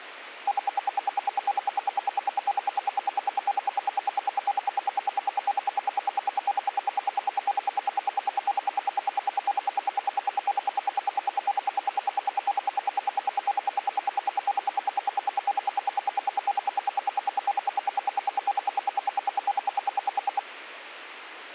Radio time signal (RWM, Moscow), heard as ten pulses a second.